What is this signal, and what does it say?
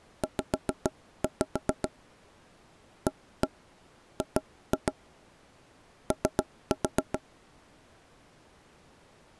Tap code, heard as knocks on wood, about 7 knocks a second. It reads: Z AG O